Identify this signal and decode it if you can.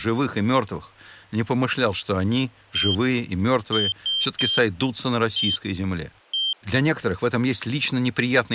Beep code, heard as a piezo beeper, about 3150 Hz, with speech in Russian. 1-3-1-1. In Phoenix BIOS tables: memory refresh test failure.